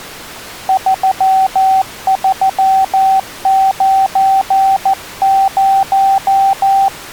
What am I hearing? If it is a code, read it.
Morse code, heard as a keyed tone, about 14 wpm, 770 Hz. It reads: 3390